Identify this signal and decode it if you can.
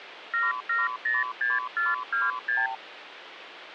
Multi-frequency trunk signalling (R2, with the far end's replies), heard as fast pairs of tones, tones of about 180 ms, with phone line noise. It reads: 7706426